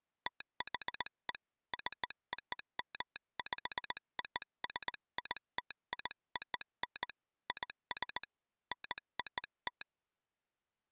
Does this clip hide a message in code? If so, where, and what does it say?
Yes: Morse code (American railroad code) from 0.2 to 9.9 s, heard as a telegraph sounder, hand-sent with a straight key. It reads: THE COMPOSITION IS NOT